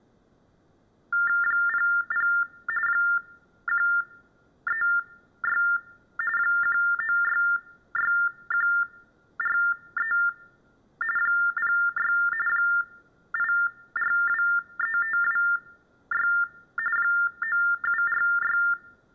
TTY/TDD text telephone tones (45.45 baud Baudot), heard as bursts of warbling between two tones, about 400 Hz shift, 1600 Hz centre. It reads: 00 136 1966143 06 8423526 9746